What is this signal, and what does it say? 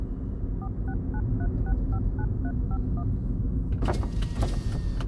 DTMF, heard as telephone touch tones, dialled by machine, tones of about 60 ms, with the noise inside a car. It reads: 4693659351